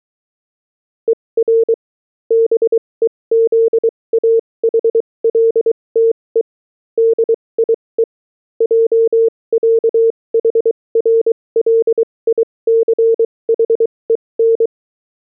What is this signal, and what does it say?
Morse code (with German letters), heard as a keyed tone, machine-sent, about 23 wpm, spaced as for 19 wpm, 460 Hz. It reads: ER BEZAHLTE DIE JÄHRLICHEN